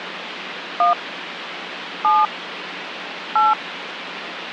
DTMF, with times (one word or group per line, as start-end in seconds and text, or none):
0.8-0.9 1
2.0-2.3 7
3.4-3.5 8